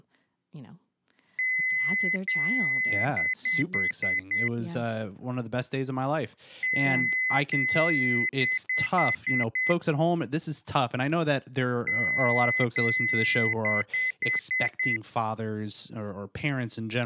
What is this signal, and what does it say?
Beep code, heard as beeps from a small speaker, played three times, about 2050 Hz, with speech in English. 2 long, 5 short.